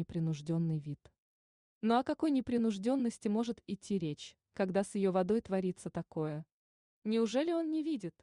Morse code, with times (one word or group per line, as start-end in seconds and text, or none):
none